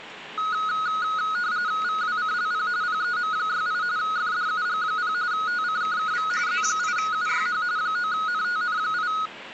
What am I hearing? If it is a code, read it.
RTTY (45.45 baud, 170 Hz shift), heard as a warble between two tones, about 1360 Hz centre, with the noise inside a car. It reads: VWCLP PEM68 FDUG0 TCKKV Z8UYH 9NTN8